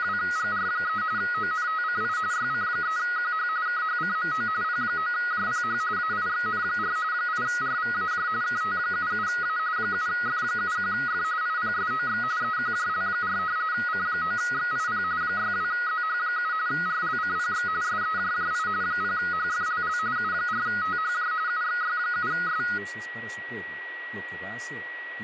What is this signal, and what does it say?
RTTY (45.45 baud, 170 Hz shift), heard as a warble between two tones, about 1360 Hz centre, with radio static, a steady whistle near 1920 Hz and speech in Spanish. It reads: … ONTCI YC3QH KHCMO P9JPH AIXN4 8RVAJ KT77A 7F71F IPSOX EQJL4 C9XIP 62ZH7 RLCPX SEJJI 0HFLL U4THJ UXY7S